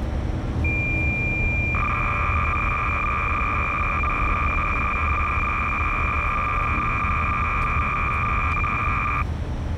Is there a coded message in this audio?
Yes: cassette data (Kansas City type), 300 baud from 0.6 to 9.2 s, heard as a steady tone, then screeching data, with the noise inside a car.